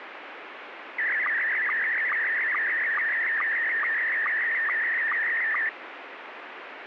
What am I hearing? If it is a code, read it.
SSTV (slow-scan television), Scottie S1, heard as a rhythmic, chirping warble, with radio static.